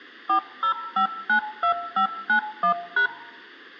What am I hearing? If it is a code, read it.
DTMF, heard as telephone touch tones, dialled by machine, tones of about 100 ms, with a squelch burst at the end. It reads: 40592591#